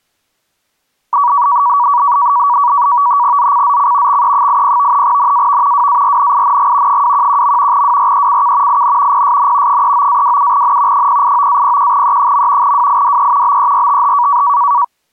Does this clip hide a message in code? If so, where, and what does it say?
Yes: NAVTEX (SITOR-B), 100 baud, 170 Hz shift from 1.1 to 14.8 s, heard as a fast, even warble, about 1050 Hz centre. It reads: ZCZC XE80 NAV WARNING 211. WRECK IN PSN 39-27N 089-01E. WIDE BERTH